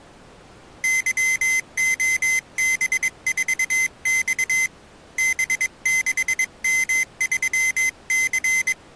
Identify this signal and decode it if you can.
Morse code, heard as a high beeper, hand-sent with a bug key, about 22 wpm, 2050 Hz. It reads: YOB4X B6M3C